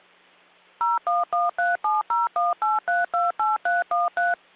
DTMF, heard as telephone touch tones, dialled by machine, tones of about 170 ms. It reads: 01137018328313